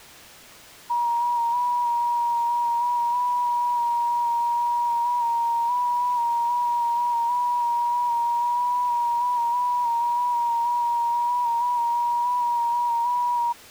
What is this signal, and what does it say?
FT8 (one signal), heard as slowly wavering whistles, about 6.25 baud.